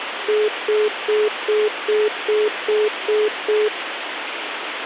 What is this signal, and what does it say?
Telephone call progress tone (single-tone plan, as in most of Europe), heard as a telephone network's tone, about 420 Hz, 0.2 s on and 0.2 s off, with phone line noise. Congestion tone.